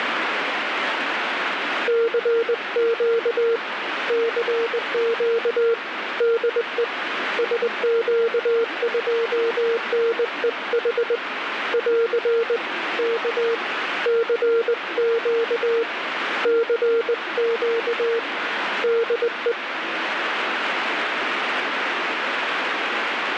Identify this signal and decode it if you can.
Morse code, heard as a keyed tone, hand-sent with a straight key, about 20 wpm, 460 Hz, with radio static. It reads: CQ CQ DE SQ2NEH <AR> K CQ CQ DE